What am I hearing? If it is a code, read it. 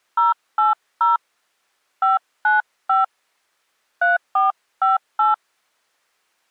DTMF, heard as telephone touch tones, dialled by hand, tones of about 150 ms. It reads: 080 595 3458